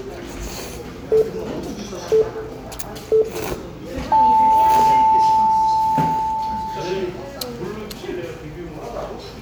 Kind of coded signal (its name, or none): radio time signal